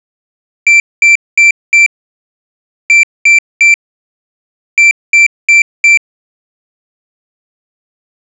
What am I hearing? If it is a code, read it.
Beep code, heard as a piezo beeper, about 2350 Hz. 4-3-4. In Phoenix BIOS tables: time-of-day clock failure.